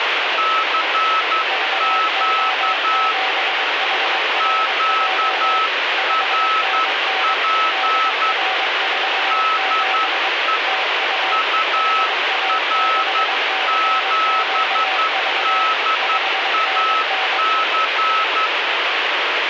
Morse code, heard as two keyed tones, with heavy radio static. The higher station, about 11 wpm, 1300 Hz: CQ QRP DE UR7DAC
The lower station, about 22 wpm, 760 Hz: VO7HRJ 5NN DR47 TU HA6CQV 5NN